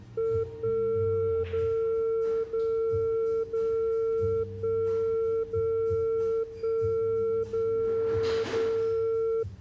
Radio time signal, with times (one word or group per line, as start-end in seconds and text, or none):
0.4-1.4 1
1.4-2.4 0
2.4-3.4 0
3.4-4.4 0
4.4-5.4 1
5.4-6.4 0
6.4-7.4 1
7.4-8.4 0
8.4-9.4 0